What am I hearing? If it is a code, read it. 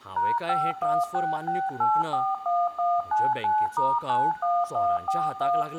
DTMF, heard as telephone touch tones, dialled by machine, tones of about 220 ms, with room echo and speech in Goan Konkani. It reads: #5166841199*91141